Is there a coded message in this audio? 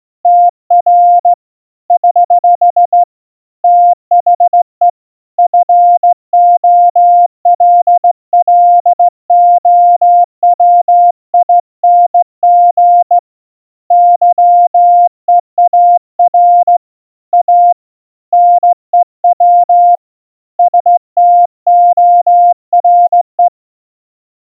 Yes: Morse code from 0.2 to 23.5 s, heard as a keyed tone, hand-sent with a straight key, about 16 wpm, 700 Hz. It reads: TR <HH> THE FOLLOWING YEAR A NEW STORE